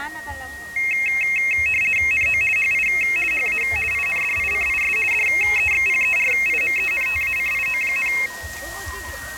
RTTY (50 baud, 450 Hz shift), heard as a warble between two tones, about 2350 Hz centre, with a steady whistle near 1880 Hz and the noise of a park. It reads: NO HI HA INDICIS DEXPERIMENTACIO,